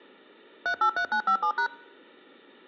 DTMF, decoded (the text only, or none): 383957#